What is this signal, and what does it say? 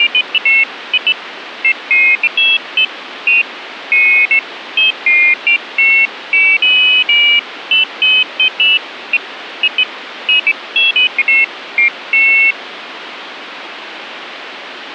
Pairs of high tones at irregular times, with phone line noise. There is no code.